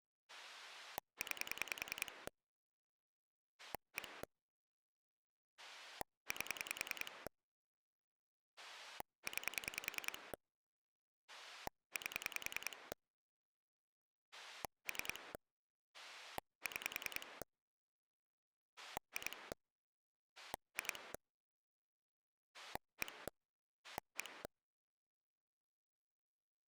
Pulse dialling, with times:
0.3-2.3 9
3.6-4.2 1
5.6-7.3 8
8.6-10.3 9
11.3-12.9 8
14.3-15.3 3
15.9-17.4 6
18.8-19.5 2
20.4-21.1 2
22.5-23.3 1
23.8-24.4 1

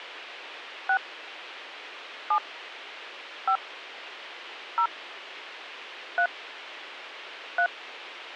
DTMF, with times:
0.9-1.0 6
2.3-2.4 7
3.5-3.6 5
4.8-4.9 0
6.2-6.3 3
7.6-7.7 3

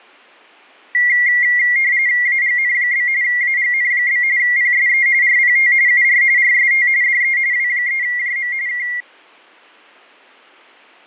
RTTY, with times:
2.3-3.1 AGN?
3.2-4.2 AGN?
4.4-5.1 PSE
5.2-5.7 RPT
5.9-6.2 UR
6.4-6.9 RST
7.0-7.4 DE
7.5-8.5 W3JM
8.7-8.9 K

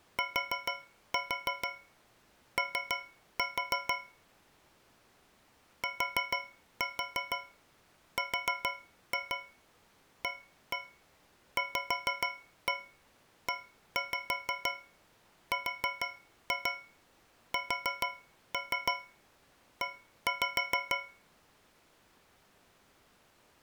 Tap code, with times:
0.2-3.9 TO
5.8-21.0 TRAVERSE

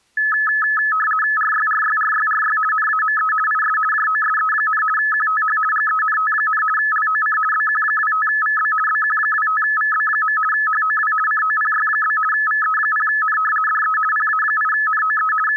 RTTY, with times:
1.4-2.6 RYRYRYRY
2.7-3.3 NAME
3.5-3.8 IS
3.9-4.8 JOSE,
5.0-5.6 QTH
5.7-6.6 GENT,
6.8-7.4 LOC
7.5-8.7 BQ25VB
8.9-10.4 BQ25VB.
10.5-11.1 HOW
11.3-12.2 COPY?
12.3-13.4 VE0N
13.7-14.0 DE
14.1-15.3 PA8NOE
15.5-15.6 …

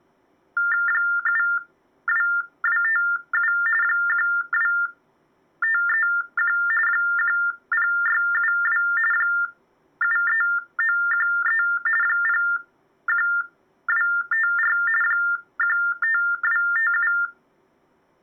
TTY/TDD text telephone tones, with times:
0.9-3.5 72257
3.8-6.6 12531
6.9-8.8 10672
9.1-11.6 73913
12.0-14.8 01254
15.0-17.1 15257

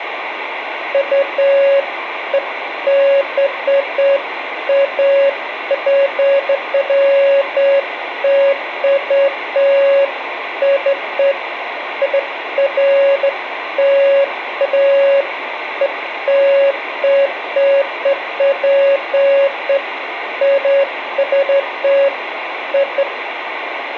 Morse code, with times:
none

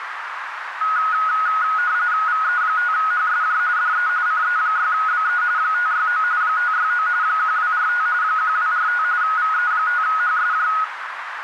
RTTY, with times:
2.3-3.6 VE5HSJ
3.8-4.1 DE
4.3-5.4 CE6BE
5.6-6.2 569
6.4-7.1 569
7.2-8.1 1245
8.2-9.0 1245
9.2-10.7 VE5HSJ

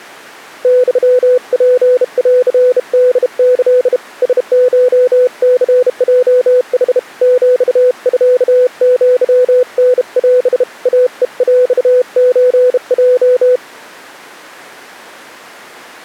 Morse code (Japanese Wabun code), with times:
0.6-4.0 ユツンホキ
4.2-7.0 ラコニヲヌ
7.2-10.6 ヒミアタオ
10.9-13.6 イヘヰソヲ

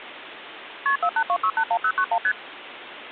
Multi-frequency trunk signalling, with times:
0.9-1.0 KP
1.0-2.2 482681091
2.2-2.3 ST

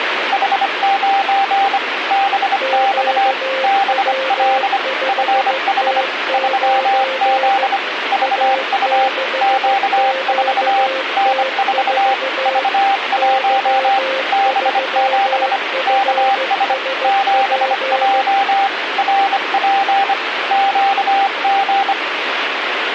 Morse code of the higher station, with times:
0.3-1.8 H9
2.1-3.3 BX
3.6-4.8 BL
5.1-6.0 FH
6.3-7.8 3Z
8.1-9.1 VU
9.4-10.9 Q4
11.2-12.1 N4
12.5-14.0 V1
14.3-15.6 B7
15.9-16.7 KS
17.0-18.7 7J
19.0-20.1 RP
20.5-21.9 QG

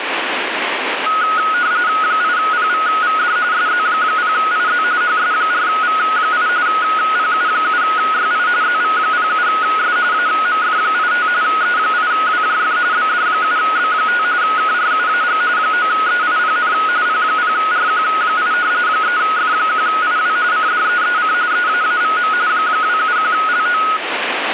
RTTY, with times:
2.0-3.4 8PVVD
3.5-4.8 SZ0IZ
5.0-6.5 HS4V8
6.7-8.5 PU7YI
8.6-10.0 ZV07S
10.1-11.3 AMF85
11.4-12.8 E8WJF
12.9-14.2 BD7B5
14.4-15.4 KRUAG
15.6-16.7 9EIPN
17.1-18.5 P0RQ8
18.9-20.4 3F1IW
20.5-21.3 CDEEC
21.5-22.3 EAAVM
22.5-23.8 271LO

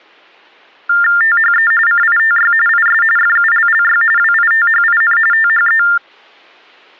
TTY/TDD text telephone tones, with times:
1.2-1.7 THE
1.9-2.5 CITY
2.7-3.0 IS
3.2-4.0 FULLY
4.2-5.2 WITHIN
5.3-5.8 THE

